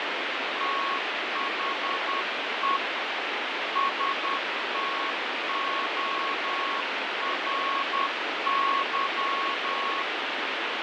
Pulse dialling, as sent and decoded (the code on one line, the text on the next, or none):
none